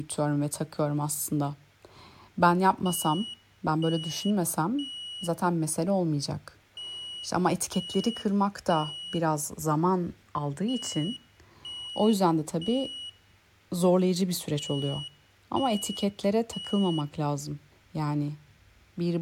Alarm pattern, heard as an alarm's beeps, played four times, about 2900 Hz, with speech in Turkish. Temporal three. Smoke or fire, evacuate.